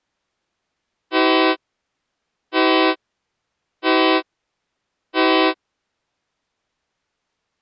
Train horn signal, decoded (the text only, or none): 4 short